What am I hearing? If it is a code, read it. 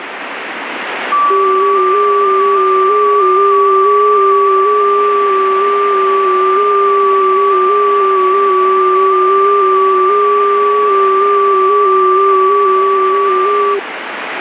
FT8 (several signals at once), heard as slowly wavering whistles, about 6.25 baud, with radio static.